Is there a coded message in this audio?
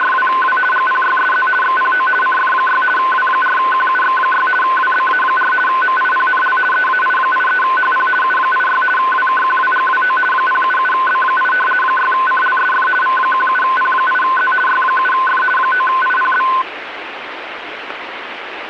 Yes: RTTY (50 baud, 450 Hz shift) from 0.0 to 16.6 s, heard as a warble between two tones, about 1270 Hz centre, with radio static. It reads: … GPYSZ XPO CF6 W4QUX6 WBA4 MIPNL EAI83HP U86 WKQWGWO 077B8 6CLSF V17P8Z Y7F 9IPB